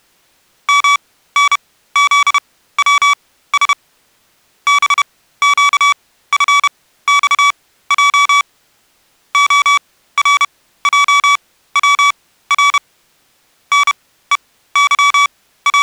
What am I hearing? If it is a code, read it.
Morse code, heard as electronic beeps, machine-sent, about 31 wpm, spaced as for 16 wpm, 1140 Hz. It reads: MNZWS BQFXJ ORJWR …